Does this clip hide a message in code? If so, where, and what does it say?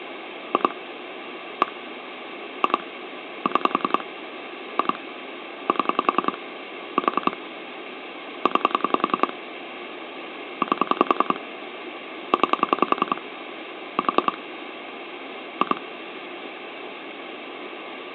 Yes: pulse dialling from 0.5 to 15.8 s, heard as clicks on a phone line, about 10 pulses a second, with phone line noise. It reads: 2 1 2 6 2 7 4 9 8 9 4 2